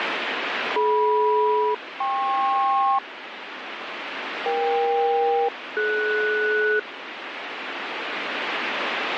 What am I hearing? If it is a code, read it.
Aircraft SELCAL, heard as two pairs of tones, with radio static. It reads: DM-KP EK-DS